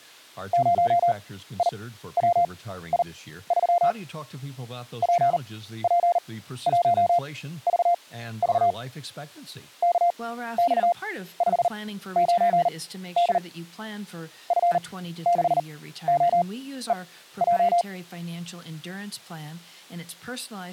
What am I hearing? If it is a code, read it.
Morse code, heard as a keyed tone, machine-sent, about 39 wpm, spaced as for 15 wpm, 700 Hz, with speech in English. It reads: 0IWI3 PP1VV KX59D F6OEJ